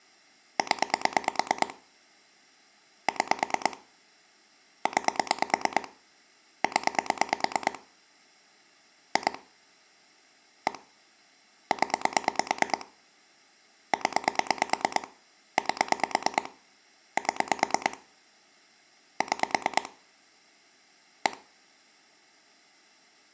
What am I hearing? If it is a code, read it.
Pulse dialling, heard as clicks on a phone line, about 9 pulses a second. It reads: 0 6 9 0 2 1 0 0 8 7 6 1